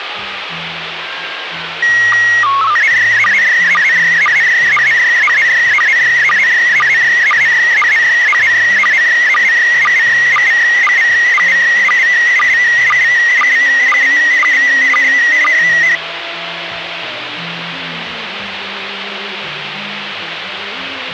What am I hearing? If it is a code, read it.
SSTV (slow-scan television), PD 120, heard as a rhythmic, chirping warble, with radio static.